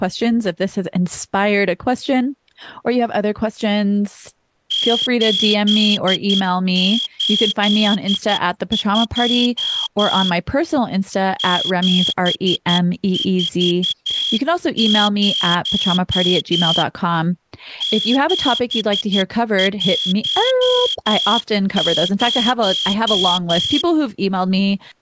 Morse code, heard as a whistle, hand-sent with a straight key, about 11 wpm, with speech in English. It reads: 882 740 710